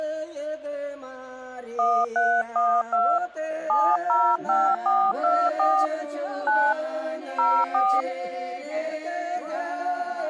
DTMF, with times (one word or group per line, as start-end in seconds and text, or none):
1.8-3.2 1312
3.7-5.9 705424
6.5-6.7 9
7.4-8.0 04